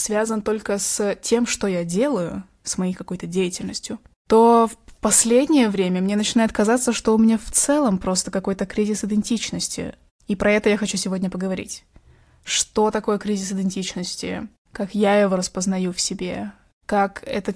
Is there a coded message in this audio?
No, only speech in Russian.